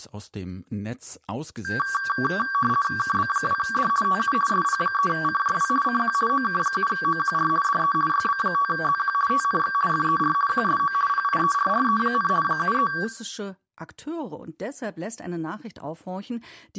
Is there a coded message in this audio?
Yes: RTTY (50 baud, 450 Hz shift) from 1.6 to 13.0 s, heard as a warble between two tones, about 1360 Hz centre, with speech in German. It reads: KB2D TU SP3CJW CQ OK7OQR DE YB5ZQ TNX FER QSO PIERRE, 73